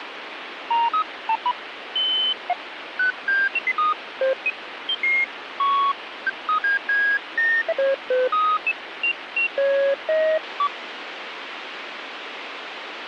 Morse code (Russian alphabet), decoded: none

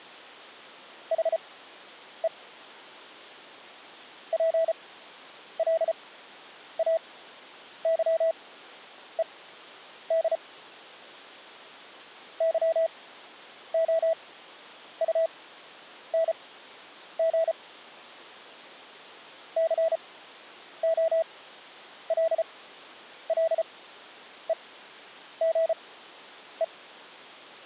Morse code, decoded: HE PLAYED YOUNG COLLEGE

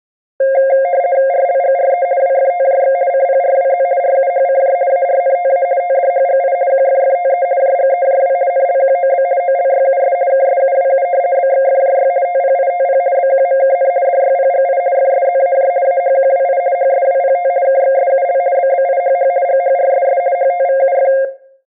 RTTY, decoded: RLGRE WFTJX CPRWZ RUHCJ ARNTA TDHGI QFFTE JGEJW NLQOB OLYUS KSUWU BXFJY TPITP BQMKN DYPGI FSZAJ AHQWI HSWPT KXSUL BBIHH GHRSS HTVUF

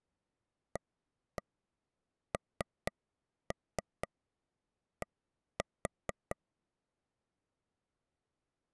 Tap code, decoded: AND

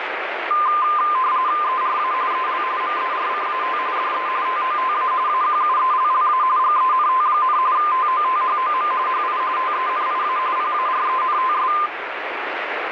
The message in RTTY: ERA EL MERCAT DE TOTA AQUELLA GENT, TOTHOM HI TENIA PARENTS

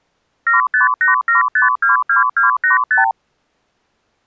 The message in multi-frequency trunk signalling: 7587522285

